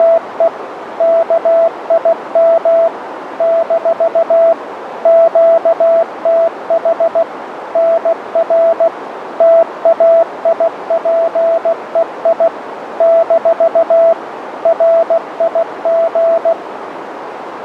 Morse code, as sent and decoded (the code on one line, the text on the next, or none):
… / -.- .. -- / -....- / --.- - .... / -. .-. / - .- .. .--. . .. / -....- / .-. .. --.
… KIM - QTH NR TAIPEI - RIG